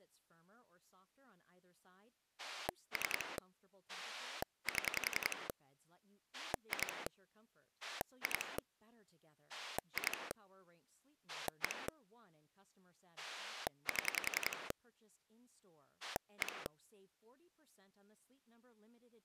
Pulse dialling, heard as a rotary dial, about 10 pulses a second, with speech in Swedish. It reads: 3 7 2 2 2 1 7 1